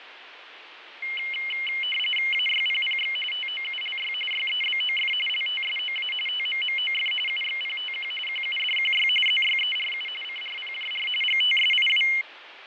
RTTY (45.45 baud, 850 Hz shift), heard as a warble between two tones, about 2550 Hz centre, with radio static and fading. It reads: AYPPX TOULY YEBOF LTSOA TMMOF UXPTQ QUDQY ZYERU CRPJR GTSIW